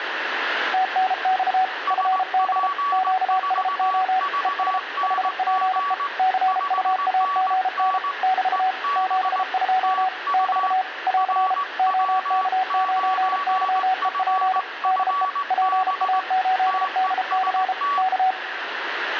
Morse code, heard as two keyed tones, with radio static. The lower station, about 33 wpm, 750 Hz: TNX FB QSO ES HPE CUAGN <BT> 72 <BT> <AR> OK9YEP DE PA8DC K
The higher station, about 19 wpm, 1140 Hz: SP4VNG 5NN EB TU RW9FFB TEST